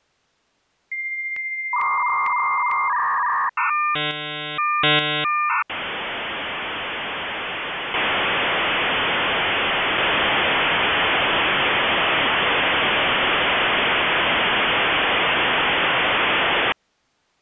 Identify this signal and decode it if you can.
Dial-up modem handshake (V.34 or later), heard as a whistle, warbles, then hiss.